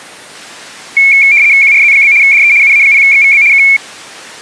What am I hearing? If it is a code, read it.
RTTY (75 baud, 170 Hz shift), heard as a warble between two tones, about 2300 Hz centre. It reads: QRZ? DE UA0XVB K